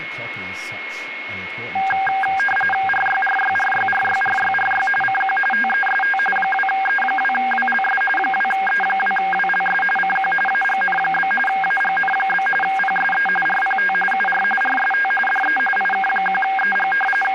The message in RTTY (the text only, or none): RYRYRYRYRYRY CQ TEST 2E2WLS 2E2WLS CQ AGN? AGN? PSE RPT UR RST DE IK1EG …